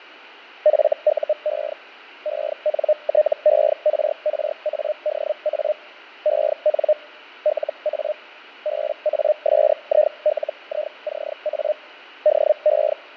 Hellschreiber (Feld-Hell, 122.5 baud), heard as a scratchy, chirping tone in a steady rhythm, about 610 Hz, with fading. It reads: FUE ENTERRADA EN LA BASILICA DE